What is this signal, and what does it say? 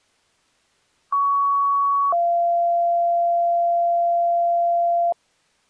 Two-tone page, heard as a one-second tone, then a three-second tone, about 1120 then 690 Hz.